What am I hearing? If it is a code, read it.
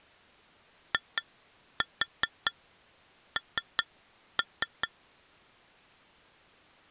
Tap code, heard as taps on glass, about 5 knocks a second. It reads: IN